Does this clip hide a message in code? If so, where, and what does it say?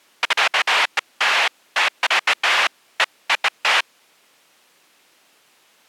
No, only bursts of noise.